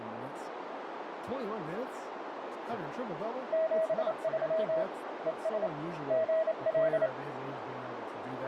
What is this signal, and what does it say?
Morse code, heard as a keyed tone, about 28 wpm, 640 Hz, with radio static, a narrow filter and speech in English. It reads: 73 ES GL